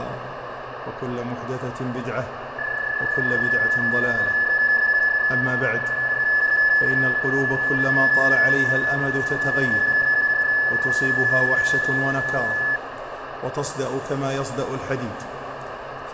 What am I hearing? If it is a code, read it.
PSK31 (31.25 baud), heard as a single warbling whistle, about 1700 Hz, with radio static, fading and room echo.